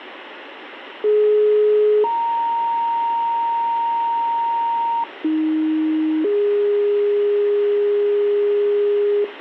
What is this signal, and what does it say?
Two-tone page, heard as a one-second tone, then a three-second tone, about 420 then 930 Hz, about 310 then 410 Hz, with radio hiss.